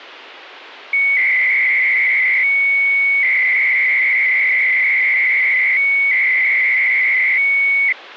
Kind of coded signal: 300-baud modem data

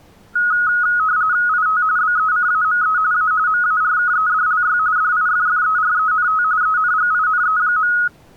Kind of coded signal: RTTY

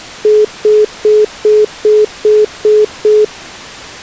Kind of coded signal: telephone call progress tone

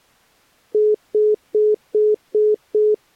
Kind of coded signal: telephone call progress tone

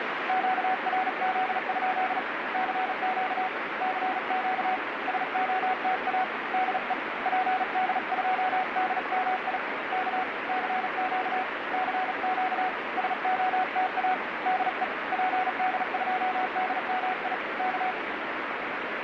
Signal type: Morse code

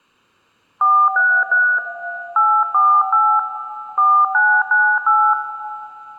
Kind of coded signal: DTMF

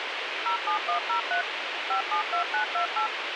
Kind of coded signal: DTMF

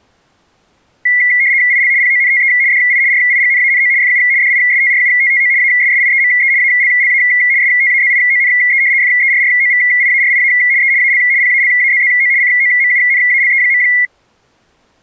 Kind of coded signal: RTTY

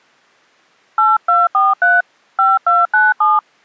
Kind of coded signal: DTMF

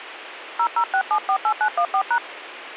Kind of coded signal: DTMF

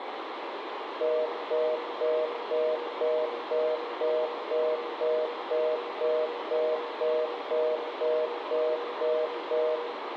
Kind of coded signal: telephone call progress tone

